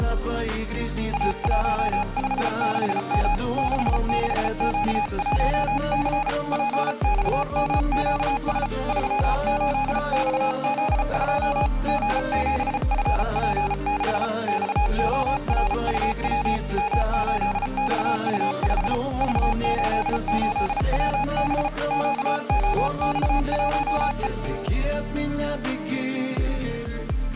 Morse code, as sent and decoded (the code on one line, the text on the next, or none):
.- .---- ..... -.... -- / -.... -.... --.- .---- -.-. / .--. -..- -- --.- ... / ...-- ---.. -..- --.. ..--- / --. --... ..-. .--. -.... / -..- --- .-. ..- .-- / -- ---.. -..- ..- ..... / ...- ---.. ---.. .-- -... / --.- --- -..- .---- .
A156M 66Q1C PXMQS 38XZ2 G7FP6 XORUW M8XU5 V88WB QOX1E